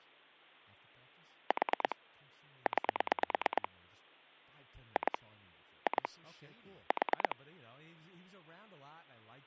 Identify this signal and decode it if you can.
Pulse dialling, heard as clicks on a phone line, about 9 pulses a second, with hum and speech in English. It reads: 4 9 2 2 4